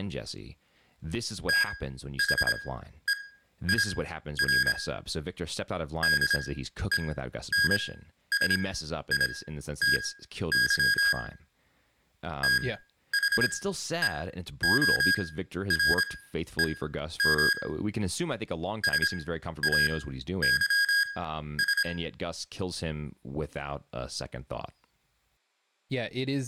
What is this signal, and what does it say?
Morse code, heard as electronic beeps, machine-sent, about 26 wpm, spaced as for 12 wpm, 1650 Hz, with room echo and speech in English. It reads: THEIR DENSITY THEOREM SAYS